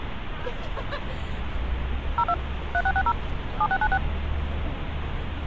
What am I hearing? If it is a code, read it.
DTMF, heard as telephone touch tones, dialled by machine, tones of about 60 ms, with phone line noise and street noise. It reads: 02 3660 7696